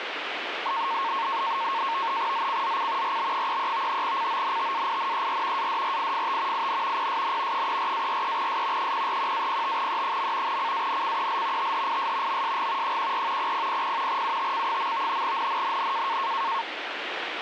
NAVTEX (SITOR-B), 100 baud, 170 Hz shift, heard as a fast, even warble, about 1000 Hz centre, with radio static. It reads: ZCZC RB33 CONTAINER ADRIFT IN PSN 34-43S 041-05E. CANCEL THIS MSG 14 0000 UTC. NNNN